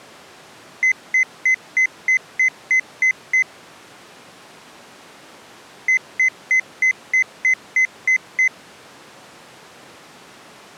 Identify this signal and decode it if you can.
Beep code, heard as beeps, played twice, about 2050 Hz. 9 short. In AMI BIOS tables: ROM checksum failure.